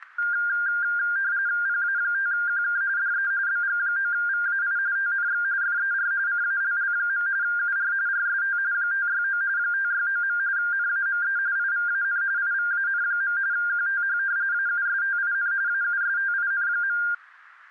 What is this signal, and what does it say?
RTTY (45.45 baud, 170 Hz shift), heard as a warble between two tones, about 1500 Hz centre, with static crashes. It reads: PA5QK DE BG9VAI TNX FER CALL. UR RST 569 569. NAME IVAN IVAN. QTH AUSTIN AUSTIN.